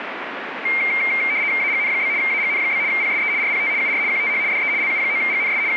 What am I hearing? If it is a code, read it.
RTTY (75 baud, 170 Hz shift), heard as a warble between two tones, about 2200 Hz centre, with radio static. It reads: AGN? AGN? PSE RPT UR QTH DE LU9GNS …